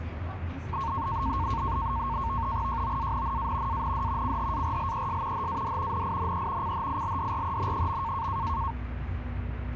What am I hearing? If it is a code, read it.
NAVTEX (SITOR-B), 100 baud, 170 Hz shift, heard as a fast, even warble, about 1000 Hz centre, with radio static and the noise inside a bus. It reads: JOANNA AND CHARLES HAD NINE CHILDREN.